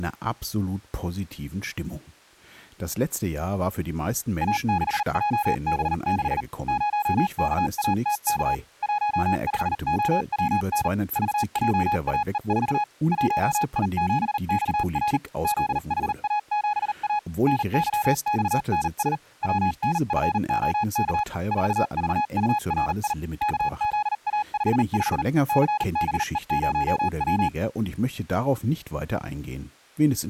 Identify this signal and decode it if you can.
Morse code, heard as a keyed tone, machine-sent, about 39 wpm, spaced as for 35 wpm, 840 Hz, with speech in German. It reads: A6JB6 0KATK 15OWN VJAE4 1I7XR ZHA7A NYXNS WNFOK 4VURI KZA55 CBE0W